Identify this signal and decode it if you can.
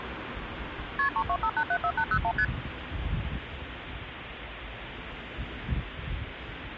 Multi-frequency trunk signalling (R1, as on North American trunks), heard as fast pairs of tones, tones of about 70 ms, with phone line noise and street noise. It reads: KP 325874801 ST